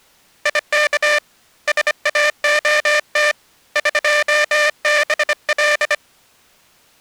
Morse code (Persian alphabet), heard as a buzzer, hand-sent with a bug key, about 25 wpm. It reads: یک ساعت قبل